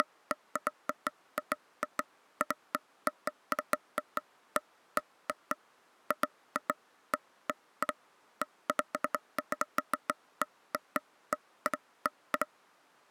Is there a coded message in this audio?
No, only irregular taps on a table.